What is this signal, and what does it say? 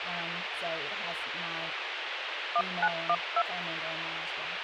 DTMF, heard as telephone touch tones, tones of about 60 ms, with radio hiss and speech in English. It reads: 1912